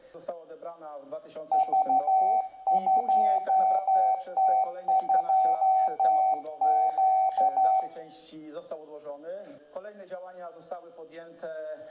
Morse code, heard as a keyed tone, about 12 wpm, 760 Hz, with room echo. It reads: V2T2Q